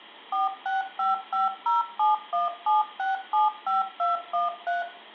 DTMF, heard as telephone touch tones, dialled by machine, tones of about 160 ms, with room echo. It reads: 46550717675213